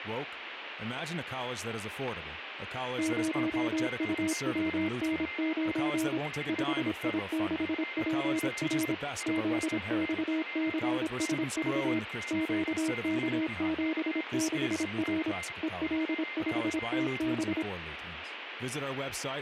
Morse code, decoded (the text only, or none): 0UWN9 5I6PR ZXCSV QK76R EL5TB